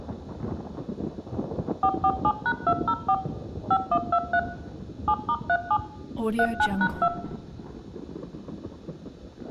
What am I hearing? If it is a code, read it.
DTMF, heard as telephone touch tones, dialled by machine, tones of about 60 ms, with room echo. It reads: 447#204 5123 7*37 39#2